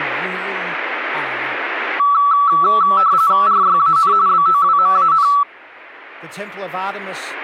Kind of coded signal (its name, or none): RTTY